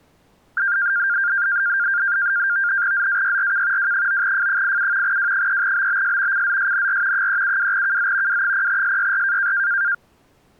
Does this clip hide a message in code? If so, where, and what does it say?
Yes: NAVTEX (SITOR-B), 100 baud, 170 Hz shift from 0.6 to 9.9 s, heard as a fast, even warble, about 1500 Hz centre. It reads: ZAYRK W9F87 W3BBS CZSNR 372KZ W0SYR